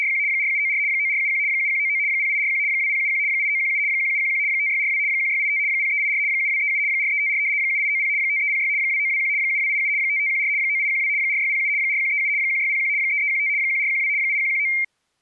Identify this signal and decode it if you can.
RTTY (75 baud, 170 Hz shift), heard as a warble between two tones, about 2200 Hz centre. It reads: … 4794 9471 7199 0841 2071 8917 1711 5642 1685 0384 7237 4354 7890 5306 2921 7287 5514 9812 4607 4137 1601 3315 1412 8119